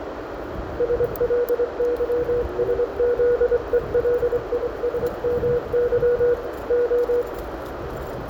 Morse code, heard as a keyed tone, hand-sent with a straight key, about 24 wpm, 480 Hz, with radio static, a narrow filter, room echo and street noise. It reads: SLYSZELISMY O